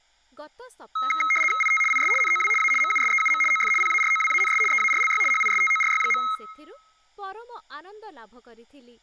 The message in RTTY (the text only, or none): IT IS NOW A MUSEUM OF PAROWANS EARLY HISTORY.